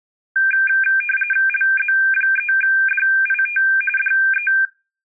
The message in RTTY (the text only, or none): LZ3DIT DE